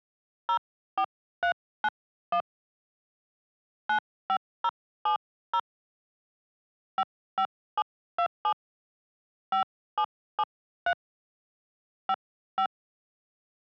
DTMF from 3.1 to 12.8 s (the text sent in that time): 95070 55727 5773 55